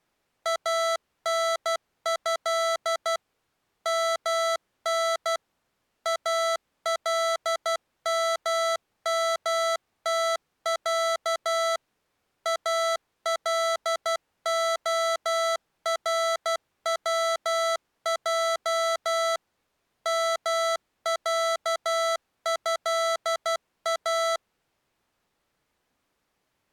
Morse code (Arabic alphabet), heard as electronic beeps, machine-sent, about 12 wpm, 660 Hz. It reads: انه من الممتع الخروج معها